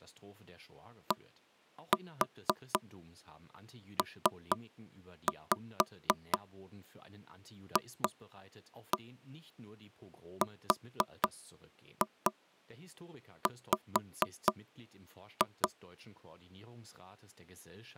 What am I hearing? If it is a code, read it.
Tap code, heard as knocks on wood, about 4 knocks a second, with speech in German. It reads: DPFRW